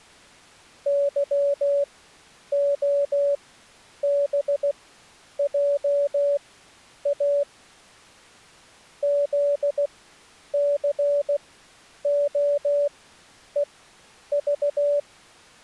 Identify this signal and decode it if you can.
Morse code, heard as a keyed tone, machine-sent, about 16 wpm, spaced as for 9 wpm, 570 Hz. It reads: YOBJA ZCOEV